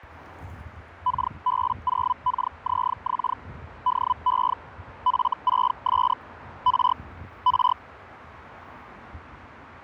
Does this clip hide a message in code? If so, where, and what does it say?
Yes: Hellschreiber (Feld-Hell, 122.5 baud) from 1.1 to 7.7 s, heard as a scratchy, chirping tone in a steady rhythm, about 1000 Hz, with street noise. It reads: KB0KZX DE F6S R R